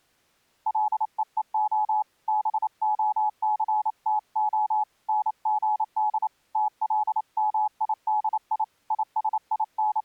Morse code (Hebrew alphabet), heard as a keyed tone, hand-sent with a paddle, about 28 wpm, 850 Hz. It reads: לווה בהסתה נגד תלמידי …